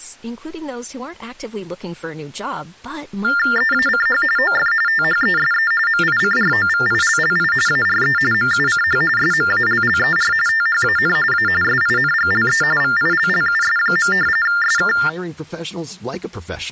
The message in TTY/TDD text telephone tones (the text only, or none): EACH OF THESE MICROVILLI ARE MUCH SMALLER THAN A SINGLE VILLUS. SK